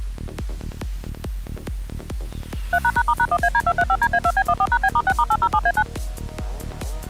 DTMF, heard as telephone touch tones, dialled by machine, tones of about 60 ms. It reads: 3##*#1AD235DA2B14#B*6*807A9